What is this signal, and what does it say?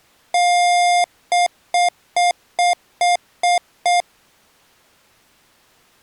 Beep code, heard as beeps from a small speaker, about 710 Hz. 1 long, 7 short.